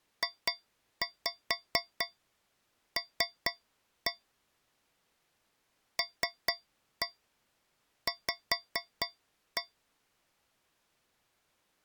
Tap code, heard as taps on a metal pipe, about 4 knocks a second. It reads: JL LV